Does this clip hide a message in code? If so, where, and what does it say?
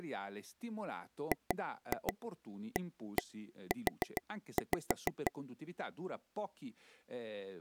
Yes: tap code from 1.3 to 5.3 s, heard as taps on a table, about 6 knocks a second, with speech in Italian. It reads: GAU